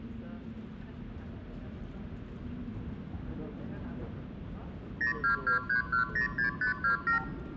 Multi-frequency trunk signalling (R2, with the far end's replies), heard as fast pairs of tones, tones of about 110 ms, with hum, room echo and the noise inside a subway train. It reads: 0223106527